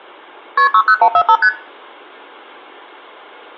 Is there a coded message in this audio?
Yes: multi-frequency trunk signalling (R1, as on North American trunks) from 0.6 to 1.5 s, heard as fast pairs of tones, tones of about 70 ms, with room echo. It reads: KP 60145 ST